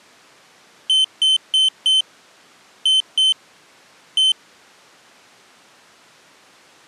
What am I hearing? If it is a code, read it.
Beep code, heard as a piezo beeper, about 3050 Hz. 4-2-1. In Phoenix BIOS tables: timer tick failure.